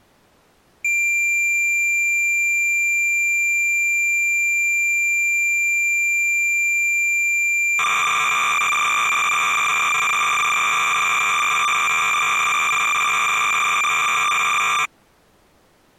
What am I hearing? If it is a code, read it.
Cassette data (Kansas City type), 300 baud, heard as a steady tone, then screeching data.